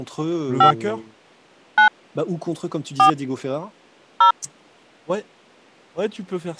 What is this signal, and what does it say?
DTMF, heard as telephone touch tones, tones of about 100 ms, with speech in French. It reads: 5 9 4 0